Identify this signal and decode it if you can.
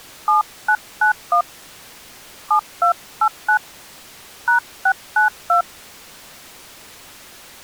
DTMF, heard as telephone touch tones, dialled by hand, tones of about 110 ms. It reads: 7991 7289 #692